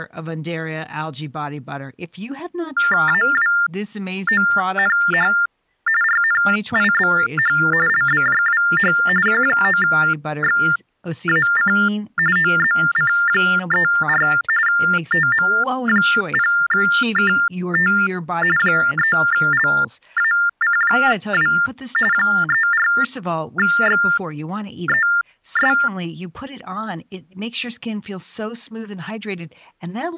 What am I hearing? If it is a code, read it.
TTY/TDD text telephone tones (45.45 baud Baudot), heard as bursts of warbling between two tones, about 400 Hz shift, 1600 Hz centre, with speech in English. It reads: AWONH RNIBH LBJWH Q9XAC OZC34 TM0KT 3LAC2 34XES